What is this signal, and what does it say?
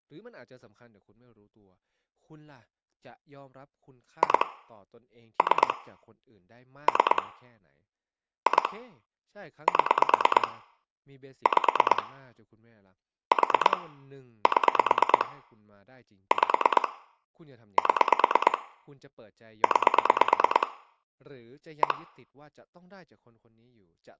Pulse dialling, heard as clicks on a phone line, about 9 pulses a second, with speech in Thai. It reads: 2 3 3 2 7 5 4 7 5 7 9 1